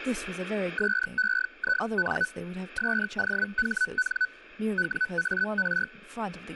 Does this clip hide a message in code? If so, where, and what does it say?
Yes: Hellschreiber (Feld-Hell, 122.5 baud) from 0.8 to 5.9 s, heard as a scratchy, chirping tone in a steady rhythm, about 1500 Hz, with speech in English. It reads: SEIN SOHN WAR